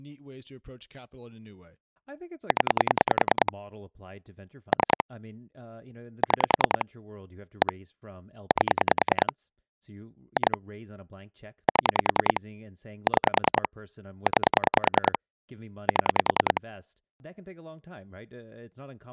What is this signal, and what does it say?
Pulse dialling, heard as clicks on a phone line, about 10 pulses a second, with speech in English. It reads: 0 3 6 1 8 2 7 6 9 7